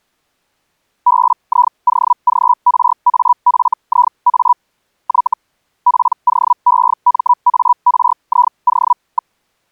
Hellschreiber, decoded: BIOGRAFIA Y POEMARIO.

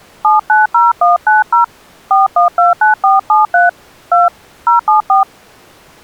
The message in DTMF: 790190 4129473 2 074

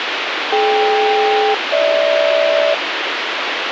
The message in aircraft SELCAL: DK-GH

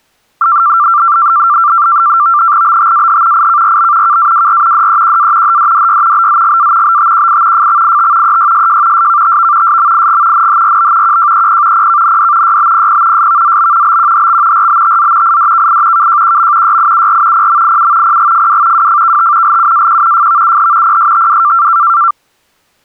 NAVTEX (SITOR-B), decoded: BTAH IKRB KAWR DEQA HDDY BZGA BTQI FXIT EYSJ SKTV SMIG NHRB QJEP PKND YBPP SVZB BQHX RBTZ IDKI KJQM YIUR PMIU PGFW WFKT LUAQ FVUH PSTW

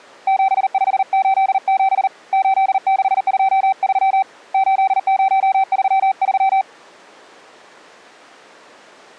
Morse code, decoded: 7587 8623 8033

